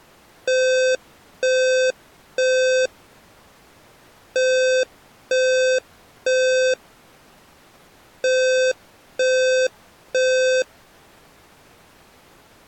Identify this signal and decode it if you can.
Alarm pattern, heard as an alarm's beeps, played three times, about 520 Hz. Temporal three. Smoke or fire, evacuate.